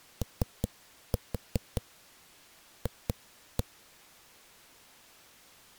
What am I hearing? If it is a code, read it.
Tap code, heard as knocks on a wall, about 5 knocks a second. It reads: OF